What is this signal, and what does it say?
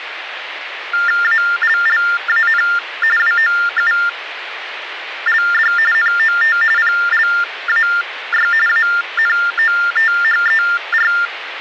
TTY/TDD text telephone tones (45.45 baud Baudot), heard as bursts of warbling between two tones, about 400 Hz shift, 1600 Hz centre, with phone line noise. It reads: ALLAN WOULD NOT PLAY ANOTHER